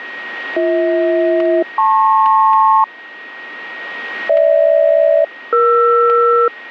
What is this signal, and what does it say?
Aircraft SELCAL, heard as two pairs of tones, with radio static, static crashes and a steady whistle near 1880 Hz. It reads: BH-LP GH-ER